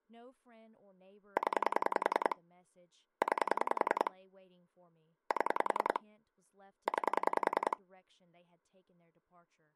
Pulse dialling, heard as clicks on a phone line, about 10 pulses a second, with speech in English. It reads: 0 9 7 9